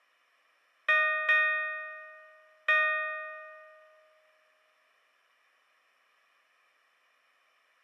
Ship's bell, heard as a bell. 3. Three half-hours of the watch have passed.